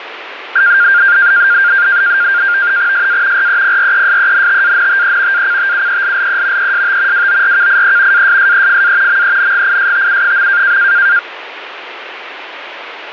NAVTEX (SITOR-B), 100 baud, 170 Hz shift, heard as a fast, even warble, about 1500 Hz centre, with radio static. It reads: SA REPRESENTANTE ACTUELLE EST WORKIE ASSEFA MENGISTU.